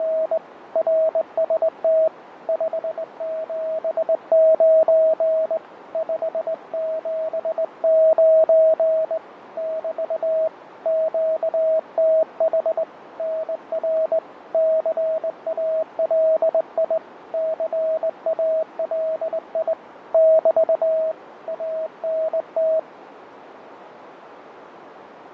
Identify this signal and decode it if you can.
Morse code, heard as a keyed tone, hand-sent with a straight key, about 20 wpm, 640 Hz, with radio static, fading and a narrow filter. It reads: … RST 579 579 <BT> QTH NR CALI CALI <BT> ANT